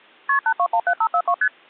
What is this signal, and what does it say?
Multi-frequency trunk signalling (R1, as on North American trunks), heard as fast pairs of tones, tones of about 70 ms. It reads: KP 8217542 ST